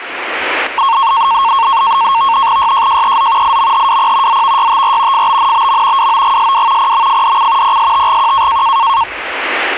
NAVTEX (SITOR-B), 100 baud, 170 Hz shift, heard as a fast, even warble, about 1000 Hz centre, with the noise of a park. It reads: YJJEZ IMHWP ZVYTR FBNBM WOGSW PMFDC PSTGQ